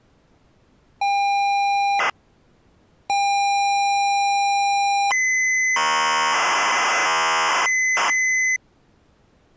ZX Spectrum tape loading, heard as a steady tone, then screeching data.